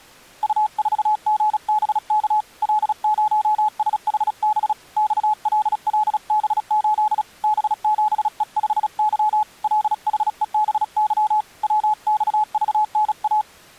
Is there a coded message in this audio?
Yes: Morse code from 0.4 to 13.5 s, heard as a keyed tone, hand-sent with a paddle, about 36 wpm, 850 Hz. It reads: U4GBK L0SHB XLLB8 B7E5Y LHEBY WXVNA